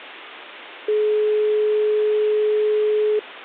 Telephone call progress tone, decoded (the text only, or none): dial tone